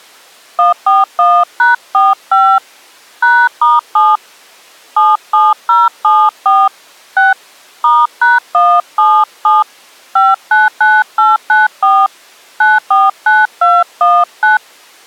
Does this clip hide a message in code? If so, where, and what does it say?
Yes: DTMF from 0.6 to 14.6 s, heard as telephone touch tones, dialled by hand, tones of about 200 ms. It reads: 141#45 #*7 77074 6 *#177 599894 949219